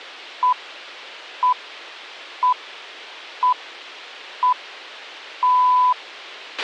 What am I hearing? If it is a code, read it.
Radio time signal (six pips, as the Greenwich Time Signal), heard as pips, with a squelch burst at the end.